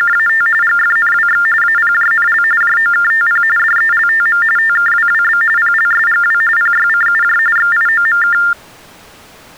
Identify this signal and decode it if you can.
TTY/TDD text telephone tones (45.45 baud Baudot), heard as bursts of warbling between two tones, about 400 Hz shift, 1600 Hz centre. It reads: … GFNWX APJNL JOKTP DELTM TKWWB PLSGW PYCUJ XIOMK